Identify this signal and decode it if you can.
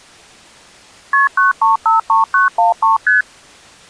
Multi-frequency trunk signalling (R1, as on North American trunks), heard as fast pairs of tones, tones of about 140 ms. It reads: KP 9353913 ST